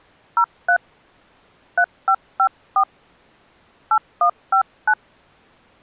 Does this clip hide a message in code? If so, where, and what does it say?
Yes: DTMF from 0.4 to 4.9 s, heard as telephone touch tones, dialled by hand, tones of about 90 ms. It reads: 03 3554 8159